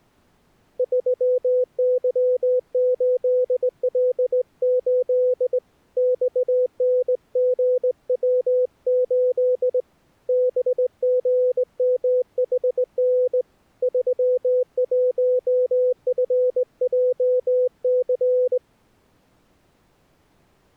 Morse code, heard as a keyed tone, hand-sent with a straight key, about 19 wpm, 500 Hz. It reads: 3Y8L8 XNGW8 BGMHN 31FJC